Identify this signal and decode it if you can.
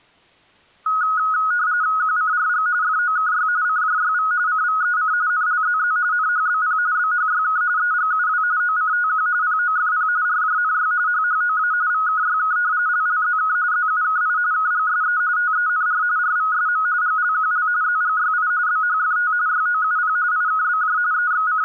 RTTY (45.45 baud, 170 Hz shift), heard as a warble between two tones, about 1360 Hz centre. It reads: QCRG FOKY CJYV CVEC NLZZ NHBP BHYK EGUW OCTQ POFP RJNY HHOA VKYK LLZK ZUKI KGSE TENR RVSM GLQL ZGYI BHFT YOUP IKBJ …